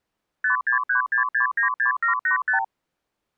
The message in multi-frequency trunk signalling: 5636696785

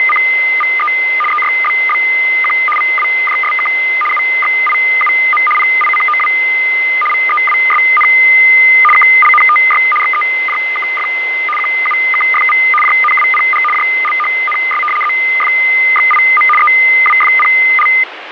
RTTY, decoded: … EYBBQ VWJSK UXIUM PICOW VEWSN KLNTY XEJKF QUKFV JNWPG JLHNS ZFXIM EWFPL

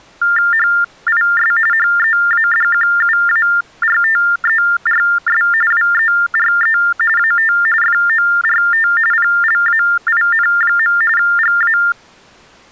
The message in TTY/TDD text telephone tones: HIS HEADQUARTERS WERE AT FORT PLAIN. GA

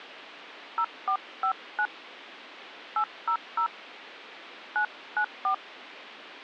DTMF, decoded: 0459 800 994

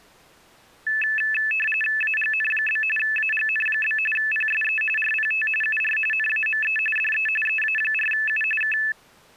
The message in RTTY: AGN? AGN? PSE RPT UR NAME DE EA4U K

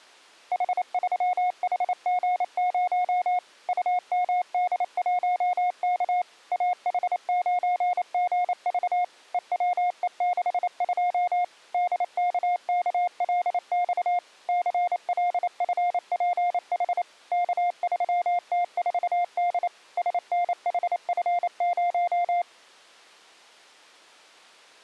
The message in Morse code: H3HG0 UMD1K AH9GV EWE62 DKKLX CLFPH K3T4D SNHF0

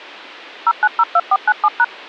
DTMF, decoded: 0902497#

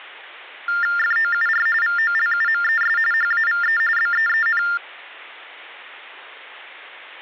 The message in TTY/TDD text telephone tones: FOUR VOLUMES HAVE BEEN

